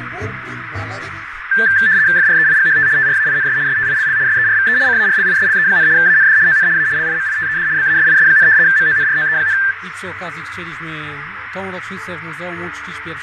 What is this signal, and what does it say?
RTTY (75 baud, 170 Hz shift), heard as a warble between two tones, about 1650 Hz centre, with radio static, fading and a narrow filter. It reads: FREIGHT TRAINS STILL SERVE CARLISLE, AND ON A LIMITED BASIS, MONROE,